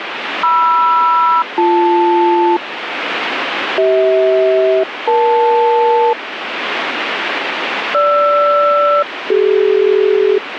Aircraft SELCAL, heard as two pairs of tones, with radio static. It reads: MR-BL CH-EL GR-CD